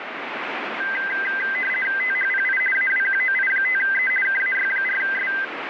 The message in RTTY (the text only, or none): THPI AWQOI5E KAY4S